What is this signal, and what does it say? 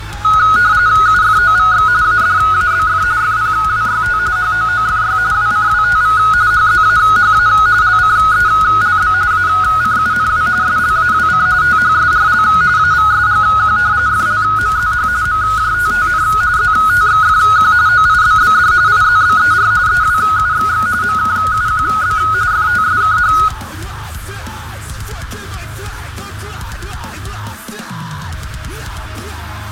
RTTY (45.45 baud, 170 Hz shift), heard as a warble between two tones, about 1360 Hz centre, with radio static. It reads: UFOVX ADABF FPWYT HOOFY WCWTV HZAHA LCELB ACUNW SLAWC THSRL AVSGQ FLMZH MJTTN ZTXFQ OIBBD IZBER EWUXX MKUQB FTSKH